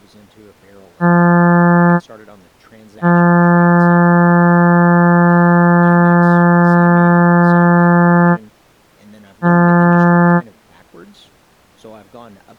Ship horn signal, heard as a ship's horn, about 170 Hz, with speech in English. 1 short, 1 long, 1 short. At sea: a vessel at anchor warns of its position.